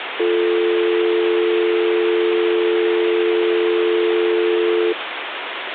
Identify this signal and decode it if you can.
Telephone call progress tone (North American or UK plan), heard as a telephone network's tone, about 350, 440 Hz, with phone line noise. Dial tone.